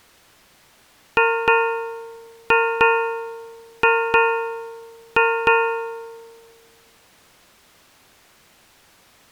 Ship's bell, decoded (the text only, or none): 8